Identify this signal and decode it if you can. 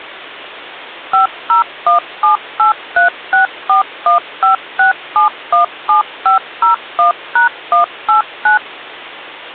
DTMF, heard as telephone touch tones, dialled by machine, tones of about 120 ms, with hum. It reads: 50178364156717501#189